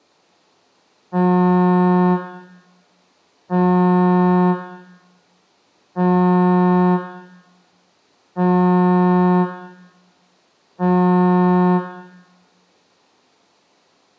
Ship horn signal, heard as a ship's horn, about 180 Hz, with room echo. 5 short. At sea: I doubt that you are doing enough to avoid a collision.